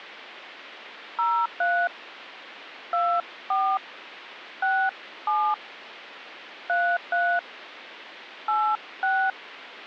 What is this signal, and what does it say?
DTMF, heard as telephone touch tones, dialled by hand, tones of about 270 ms. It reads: 03 24 67 33 86